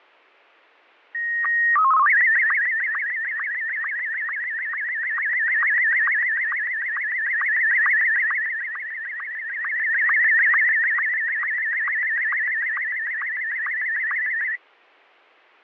SSTV (slow-scan television), Martin M1, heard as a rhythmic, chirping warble, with fading.